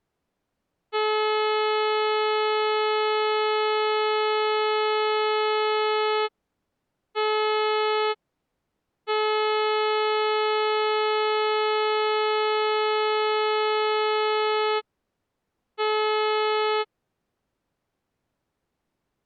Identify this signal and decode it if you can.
Ship horn signal, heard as a ship's horn, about 430 Hz. 1 long, 1 short, 1 long, 1 short. At sea: I agree to be overtaken.